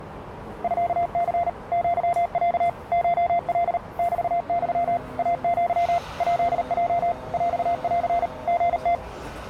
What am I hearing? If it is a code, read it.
Morse code (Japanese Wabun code), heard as a keyed tone, machine-sent, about 38 wpm, 690 Hz, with radio static and the noise of a subway station. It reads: ミニ アロ コカ メユ イア ヱヲ ヰン リム